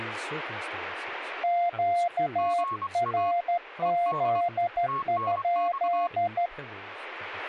Morse code, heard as two keyed tones, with speech in English. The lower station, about 13 wpm, 700 Hz: QRZ?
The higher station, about 24 wpm, 1100 Hz: GA ED TNX